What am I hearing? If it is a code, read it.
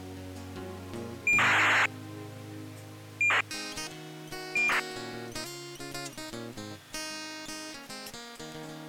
ACARS aircraft data, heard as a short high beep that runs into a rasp, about 2400 baud.